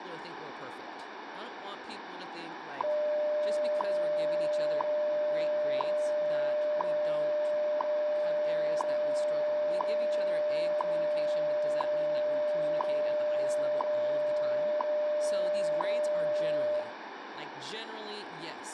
Radio time signal (WWV, Colorado), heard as ticks, one a second, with radio static, room echo and speech in English.